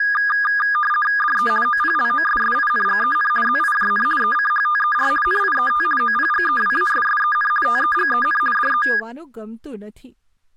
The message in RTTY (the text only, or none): DE OPLOSSINGEN ZIJN ECHTER NIET OPGEWASSEN TEGEN DE